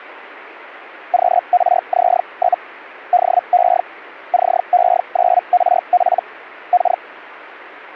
Hellschreiber (Feld-Hell, 122.5 baud), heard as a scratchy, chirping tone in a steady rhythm, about 720 Hz. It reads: QRZ? DE CE9RP K